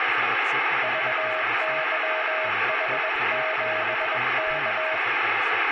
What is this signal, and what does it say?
Morse code, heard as a keyed tone, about 21 wpm, 630 Hz, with radio static and speech in English. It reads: VYH7K